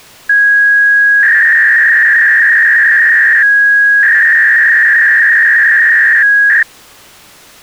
300-baud modem data (V.21 tones), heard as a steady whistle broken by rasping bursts, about 300 baud, 200 Hz shift.